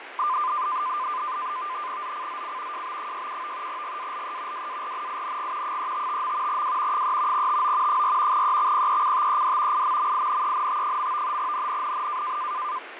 NAVTEX (SITOR-B), 100 baud, 170 Hz shift, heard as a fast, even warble, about 1110 Hz centre, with radio static and fading. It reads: ZCZC JB67 GALE WARNING 355. W 3 TO 4 EXPECTED IMMINENT. NNNN